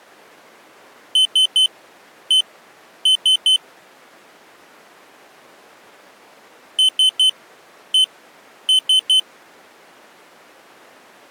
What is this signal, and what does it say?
Beep code, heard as a piezo beeper, played twice, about 3050 Hz. 3-1-3. In Phoenix BIOS tables: interrupt mask register failure.